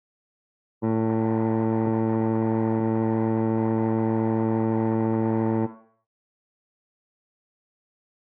Ship horn signal, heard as a ship's horn, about 110 Hz, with room echo. 1 long. At sea: a vessel nearing a blind bend, or under power and making way in fog.